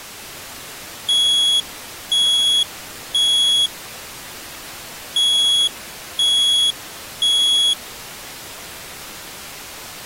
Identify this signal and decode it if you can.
Alarm pattern, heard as an alarm's beeps, played twice, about 3350 Hz. Temporal three. Smoke or fire, evacuate.